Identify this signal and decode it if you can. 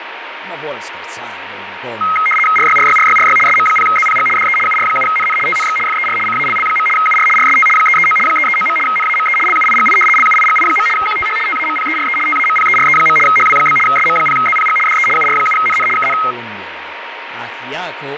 RTTY (75 baud, 850 Hz shift), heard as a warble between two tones, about 1700 Hz centre, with radio static, fading and speech in Italian. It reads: RYRYRYRY SM0ZPG DE UR7NN TNX FER CALL. UR RST 339 339. NAME LUIGI LUIGI. QTH TAMPERE TAMPERE. HW? SM0ZPG DE UR7NN KN